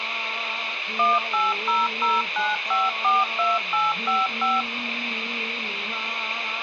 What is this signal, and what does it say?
DTMF, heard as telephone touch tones, dialled by machine, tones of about 190 ms, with phone line noise. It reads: 18009542855